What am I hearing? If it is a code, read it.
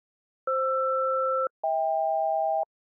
Aircraft SELCAL, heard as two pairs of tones. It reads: FR-HK